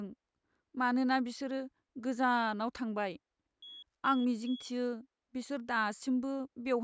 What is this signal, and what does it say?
Beep code, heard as a piezo beeper, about 3350 Hz, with speech in Bodo. 3 short. In AMI BIOS tables: failure in the first 64 KB of memory; in Dell tables: chipset error.